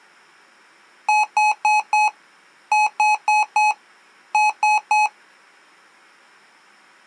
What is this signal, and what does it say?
Beep code, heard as beeps from a small speaker, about 850 Hz. 4-4-3. In Phoenix BIOS tables: maths coprocessor failure.